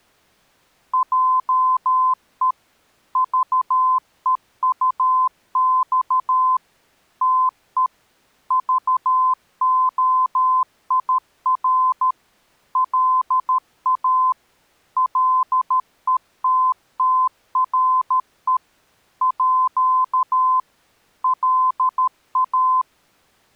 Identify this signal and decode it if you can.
Morse code (with French letters), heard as a keyed tone, machine-sent, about 13 wpm, 1030 Hz. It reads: JE VEUX TE VOIR LA LETTRE À LA